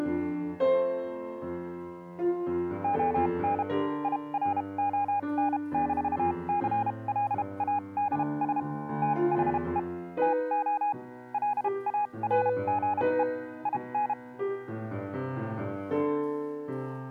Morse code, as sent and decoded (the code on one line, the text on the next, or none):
--- -. / .. .-. --- -. -....- -.-. .-.. .- -.. ... / - .... . / - --- / .-.. .- .-. --. . / .. -.
ON IRON-CLADS THE TO LARGE IN